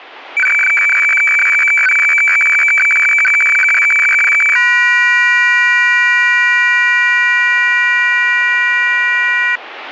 Weather fax (radiofax), 120 lines a minute, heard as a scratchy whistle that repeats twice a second, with radio static.